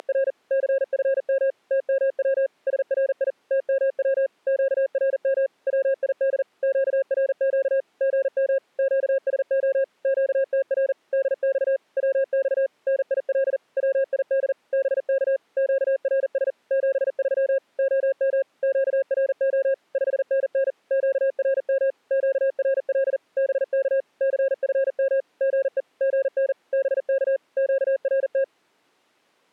Morse code, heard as a keyed tone, machine-sent, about 40 wpm, 540 Hz. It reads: … CFM TMW SRI TMW QRM WID QRQ GM QSO QTR DX WX NIL WID BK QRS 73 OM QRO 5NN QRM QRL BK CFM GE GN BK QRT